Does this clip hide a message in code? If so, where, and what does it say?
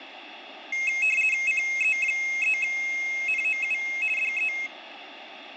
Yes: RTTY (50 baud, 450 Hz shift) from 0.7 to 4.7 s, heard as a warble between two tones, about 2350 Hz centre, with radio static and room echo. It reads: CE3NOU DE